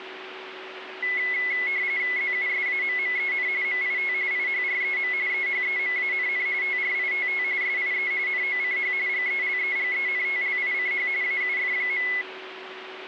RTTY (45.45 baud, 170 Hz shift), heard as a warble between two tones, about 2100 Hz centre, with radio static and a steady whistle near 380 Hz. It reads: ZUSAMMEN MIT IHREM EHEMANN TRITT SIE NOCH GELEGENTLICH AUF.